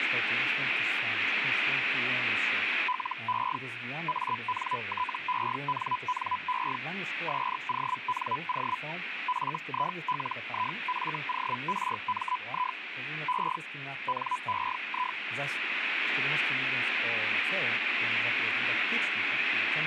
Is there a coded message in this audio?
Yes: Hellschreiber (Feld-Hell, 122.5 baud) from 2.9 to 15.2 s, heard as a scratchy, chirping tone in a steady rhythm, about 1000 Hz, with radio static. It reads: LE ANTENNE SONO FILIFORMI E NEI